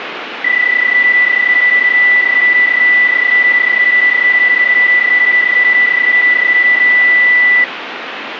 PSK31 (31.25 baud), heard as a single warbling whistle, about 2000 Hz, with radio static.